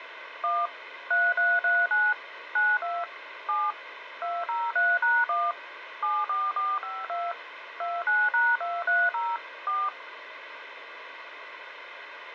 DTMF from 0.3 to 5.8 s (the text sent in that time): 1 3339 92 7 203#1